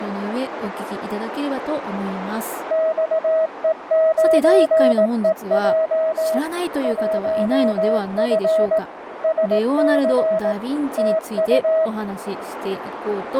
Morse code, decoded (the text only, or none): XE9EJ 1F SC TU